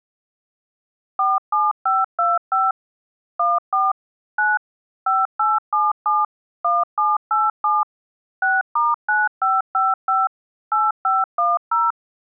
DTMF, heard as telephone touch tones, dialled by machine, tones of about 190 ms. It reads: 47525 14 9 5877 1787 6*9555 8510